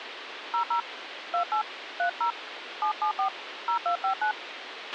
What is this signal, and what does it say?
DTMF, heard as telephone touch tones, dialled by hand, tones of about 100 ms, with radio hiss and a squelch burst at the end. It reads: 00 28 30 774 0259